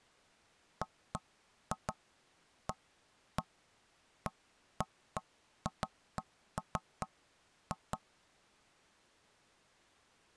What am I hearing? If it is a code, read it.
Irregular knocks on wood. There is no code.